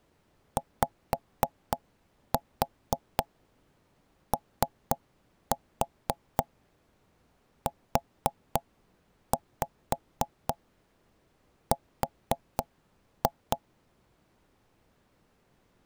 Tap code, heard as knocks on wood, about 4 knocks a second. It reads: YOUR